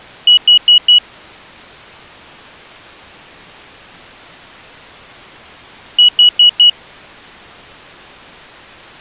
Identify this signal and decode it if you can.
Alarm pattern, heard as an alarm's beeps, played twice, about 2900 Hz. Temporal four. Carbon monoxide.